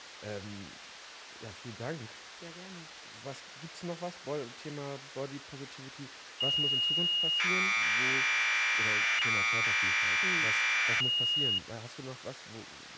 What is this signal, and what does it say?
Commodore tape loading (standard loader), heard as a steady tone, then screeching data, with speech in German.